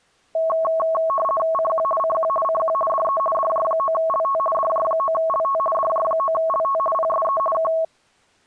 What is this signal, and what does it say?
RTTY (50 baud, 450 Hz shift), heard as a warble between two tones, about 870 Hz centre. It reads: CQ CQ CQ DE DJ9LT DJ9LT DJ9LT PSE K